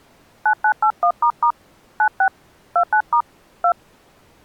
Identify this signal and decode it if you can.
DTMF, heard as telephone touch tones, dialled by hand, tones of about 80 ms. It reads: 9981** 96 29* 2